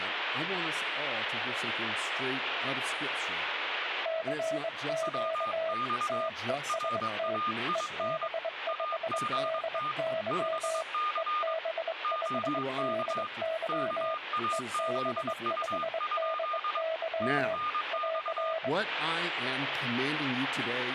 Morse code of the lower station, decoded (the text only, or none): CQ TEST EB5DY EB5DY EB5DY <AR>